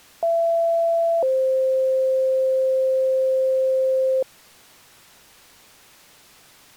Two-tone page, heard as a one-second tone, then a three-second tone, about 670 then 520 Hz.